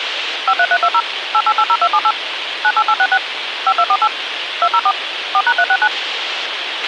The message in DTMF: 53320 8880278 98866 5248 204 4#369

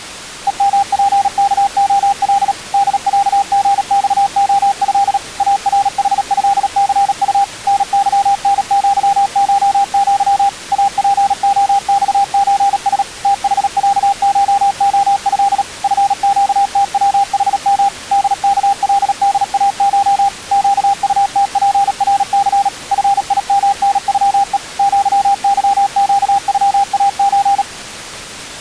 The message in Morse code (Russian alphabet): ЕМПКОЛ ДЯГЬОЭ АРХЭЦУ НЫНЪШЪ АПОЬЧС ТХЯШОЭ ФЩТВХМ ДКЛДАШ ЩУТПРЦ ФИМНЮЕ ЪЫЩЮАЧ

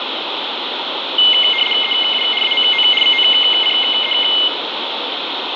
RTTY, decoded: EU AMO VOCE

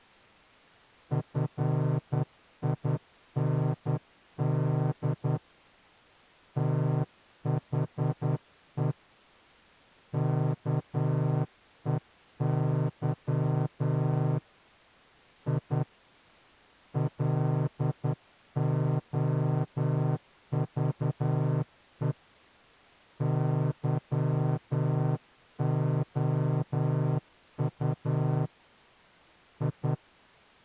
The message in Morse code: FIND THE KEY I LOVE YOU I

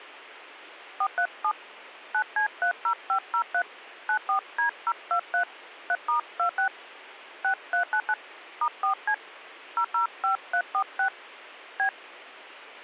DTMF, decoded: 437 9C30503 94D023 3*26 6399 *4C 005346 B

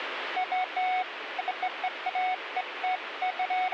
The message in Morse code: none

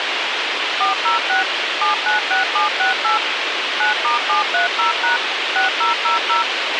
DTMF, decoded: 406 796768 9*730# 6000

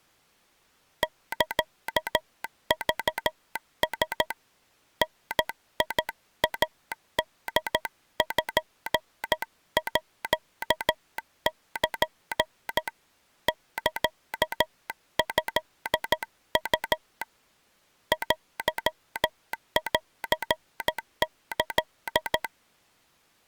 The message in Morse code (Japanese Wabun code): サクラ ダイポール サトウ テンキ

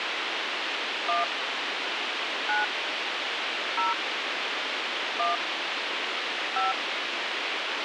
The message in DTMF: 1 9 0 1 5

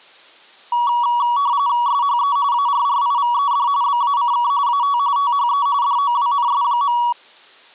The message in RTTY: SHE ARRIVED BACK AT THE DOWNS.

